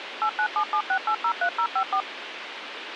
DTMF, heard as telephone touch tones, dialled by machine, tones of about 80 ms, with radio hiss. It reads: 89776803054